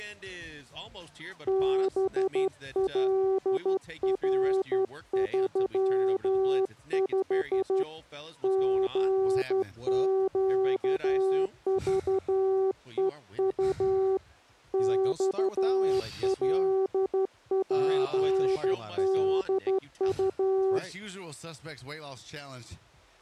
Morse code, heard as a keyed tone, hand-sent with a straight key, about 12 wpm, 380 Hz. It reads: BLR35 GQVEU XLPDU